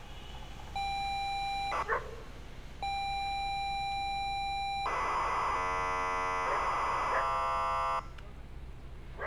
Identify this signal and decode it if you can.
ZX Spectrum tape loading, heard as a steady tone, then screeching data, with street noise.